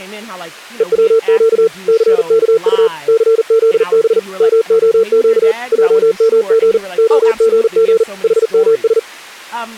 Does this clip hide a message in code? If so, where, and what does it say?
Yes: Morse code (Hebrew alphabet) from 0.7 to 9.1 s, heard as a keyed tone, machine-sent, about 40 wpm, 450 Hz, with speech in English. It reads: וצק סכט סזב מהק עמג הגג חמש